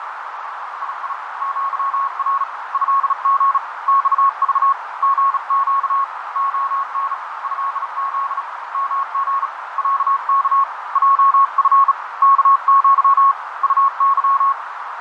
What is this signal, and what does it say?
Morse code (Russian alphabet), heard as a keyed tone, hand-sent with a bug key, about 36 wpm, 1100 Hz, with heavy radio static, fading and a narrow filter. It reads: ИИ ЪР ЭГ ЬЖ ГЩ ОН ЭЗ МГ ЯК ЙФ КЪ УЫ